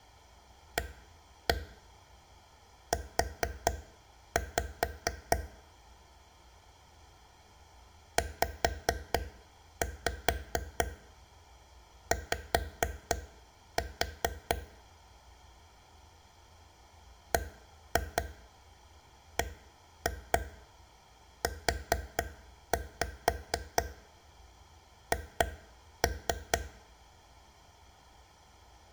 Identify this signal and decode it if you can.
Tap code, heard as taps on a table, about 4 knocks a second. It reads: AU ZY BBUH